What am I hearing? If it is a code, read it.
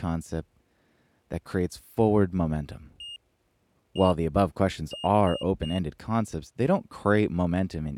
Beep code, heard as a piezo beeper, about 2850 Hz, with speech in English. 1-1-3. In Phoenix BIOS tables: CMOS read or write failure.